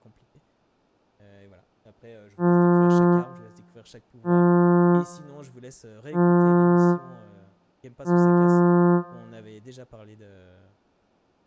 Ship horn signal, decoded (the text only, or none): 4 short